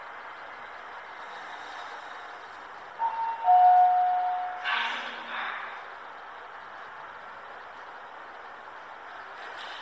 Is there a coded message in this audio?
No, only the noise inside a lift.